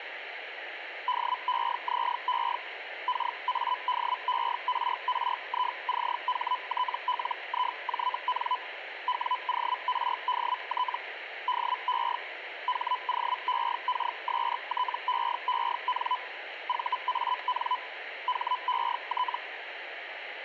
Hellschreiber (Feld-Hell, 122.5 baud), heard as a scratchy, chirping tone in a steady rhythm, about 1000 Hz. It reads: DEZE KADERRICHTLIJN WORDT DE HOEKSTEEN VAN HET